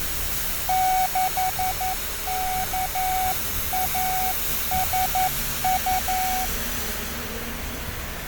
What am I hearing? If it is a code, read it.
Morse code, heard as a keyed tone, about 11 wpm, 750 Hz, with radio static and street noise. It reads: 6KASU